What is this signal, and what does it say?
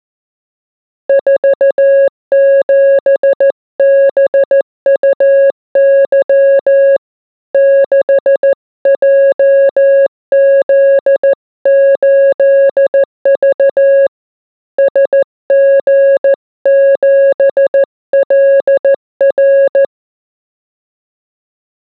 Morse code, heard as a keyed tone, hand-sent with a paddle, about 14 wpm, 550 Hz. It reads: 47BUY 6JZ8V SG7LR